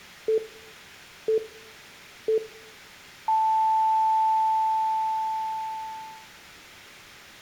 Radio time signal (three low pips and a long one an octave up, as on NHK), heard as pips, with room echo.